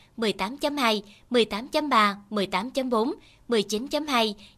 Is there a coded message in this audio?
No, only speech in Vietnamese.